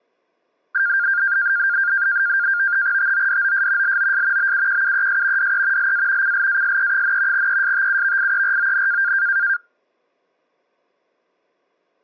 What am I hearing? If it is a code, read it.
NAVTEX (SITOR-B), 100 baud, 170 Hz shift, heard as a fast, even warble, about 1500 Hz centre. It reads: TODOS LOS BUQUES DE LA CLASE, ESTUVIERON